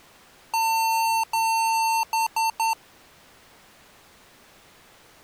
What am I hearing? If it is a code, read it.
Beep code, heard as beeps from a small speaker, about 900 Hz. 2 long, 3 short.